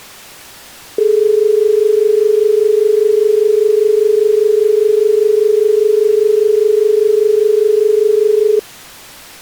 Telephone call progress tone (as in Australia), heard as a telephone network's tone, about 430 Hz. Dial tone.